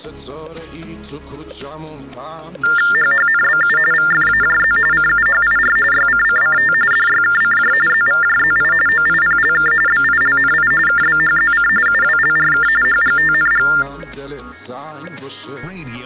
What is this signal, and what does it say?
TTY/TDD text telephone tones (45.45 baud Baudot), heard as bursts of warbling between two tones, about 400 Hz shift, 1600 Hz centre. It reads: HHNBU VFAJZ CUHIR YCCCT DYKCJ ZVJZI OIPLK BILNI KBHZC UWLRK HGTNG